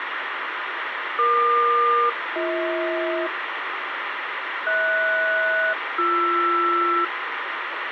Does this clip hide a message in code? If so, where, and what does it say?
Yes: aircraft SELCAL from 1.2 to 7.0 s, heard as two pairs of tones, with radio hiss and a squelch burst at the end. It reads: EQ-BH HS-BR